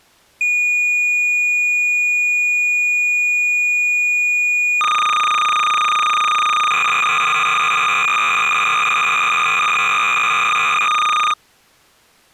Cassette data (Kansas City type), 300 baud, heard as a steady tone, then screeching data.